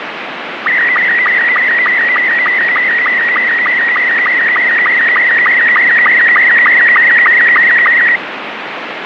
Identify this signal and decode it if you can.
SSTV (slow-scan television), Robot 72, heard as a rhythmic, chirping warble, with radio static.